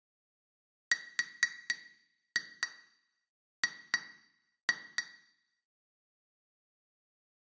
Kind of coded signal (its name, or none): tap code